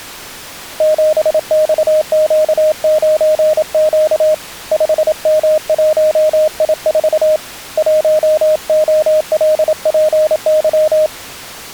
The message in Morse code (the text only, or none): 7XQ9Q 5M1I4 1OLPY